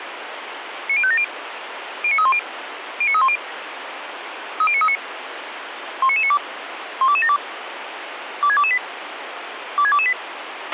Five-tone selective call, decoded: 90570 09310 09310 30939 19992 12272 26228 26228

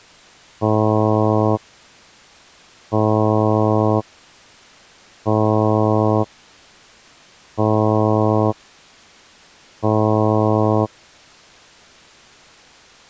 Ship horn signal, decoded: 5 short

